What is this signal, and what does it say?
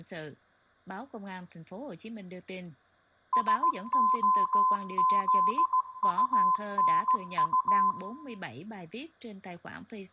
Morse code, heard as a keyed tone, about 16 wpm, 1020 Hz, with room echo. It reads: SOZUNU